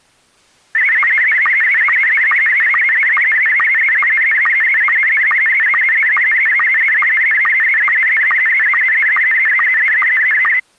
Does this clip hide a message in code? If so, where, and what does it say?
Yes: SSTV (slow-scan television), Scottie S1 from 0.7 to 10.6 s, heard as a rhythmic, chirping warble.